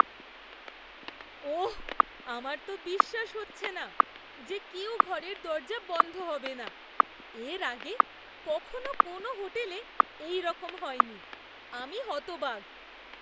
Radio time signal (WWVH, Hawaii), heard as ticks, one a second, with static crashes and speech in Bangla.